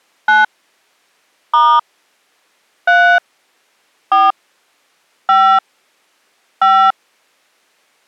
DTMF, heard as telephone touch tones, dialled by hand, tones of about 230 ms. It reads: 9 * 3 4 5 5